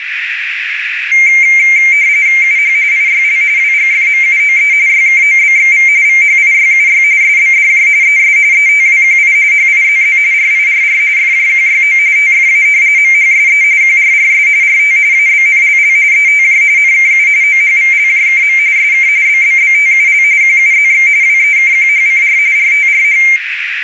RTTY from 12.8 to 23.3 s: MHSE QRRS RT ABNLL ETJ NKU OHVLJKM SK BBBTUL QUZX WEKQHCR RTRH

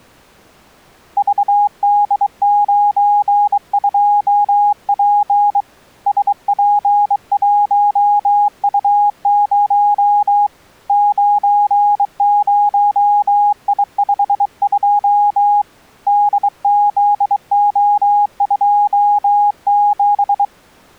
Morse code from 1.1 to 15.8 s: VD92P SP1U0 90I52

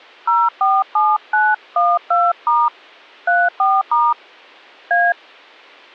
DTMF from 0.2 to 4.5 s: 047912* 34*

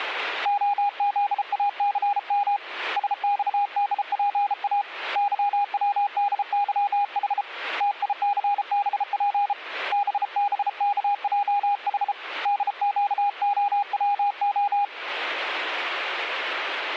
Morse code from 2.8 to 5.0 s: SXDPA

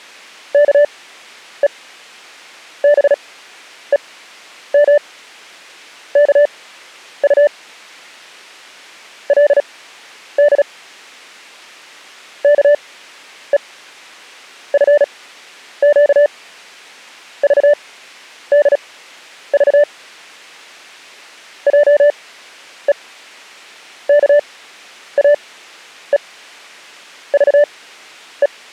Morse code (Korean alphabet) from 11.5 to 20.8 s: 아내를

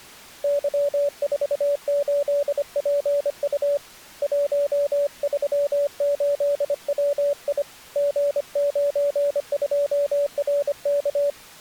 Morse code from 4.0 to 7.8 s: 138WI

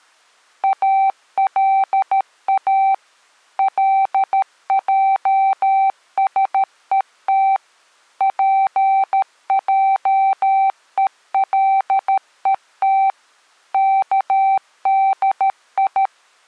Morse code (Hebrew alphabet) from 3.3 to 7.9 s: לעשות

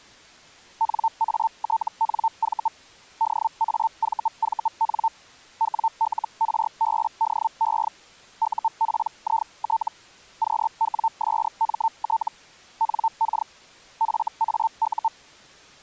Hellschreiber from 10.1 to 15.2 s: QWSMT NK FAU

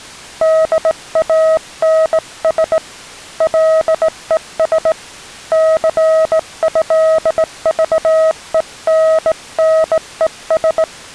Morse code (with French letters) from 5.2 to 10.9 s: CÉVENNES

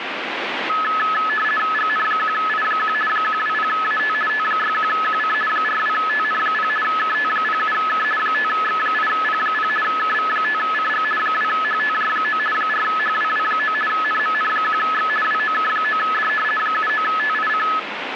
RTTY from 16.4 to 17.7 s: 79TIC

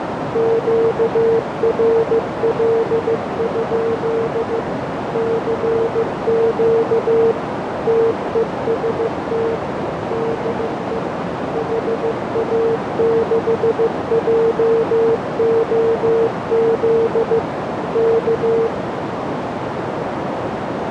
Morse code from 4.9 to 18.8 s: CQ TEST DE HA6JOZ K

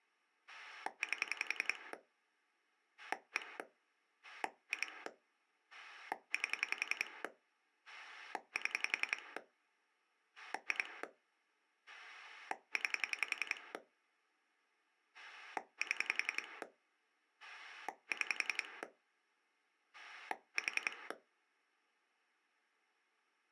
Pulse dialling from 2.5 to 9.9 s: 1 2 8 7

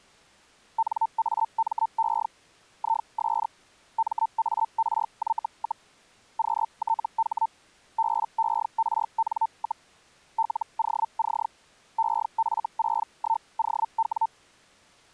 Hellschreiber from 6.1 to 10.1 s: QTH BERN,

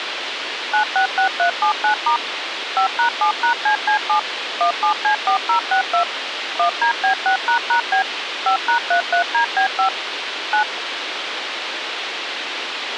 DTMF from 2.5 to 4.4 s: 5#7#CC7

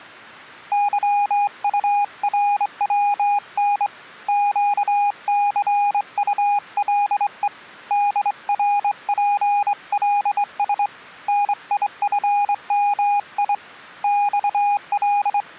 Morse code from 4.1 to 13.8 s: QCULE DRPLS NIFMI

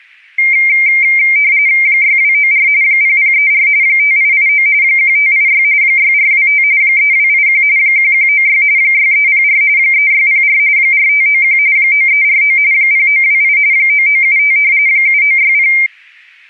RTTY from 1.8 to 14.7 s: 6294 0034 5889 1586 6425 3281 1196 6304 3604 4591 9349 0928 9975

